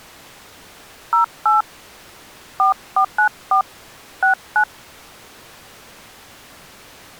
DTMF, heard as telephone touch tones, dialled by hand, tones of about 120 ms. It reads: 08 4494 69